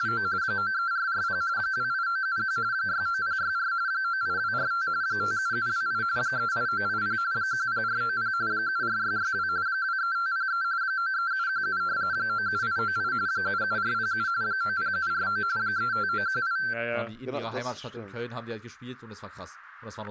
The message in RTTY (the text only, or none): … 93440 28971 69064 98245 57728 38980 10490 74662 23503 93717 97898 77407 90749 35918